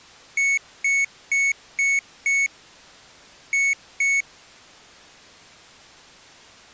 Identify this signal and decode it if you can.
Beep code, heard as a piezo beeper, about 2200 Hz. 5-2.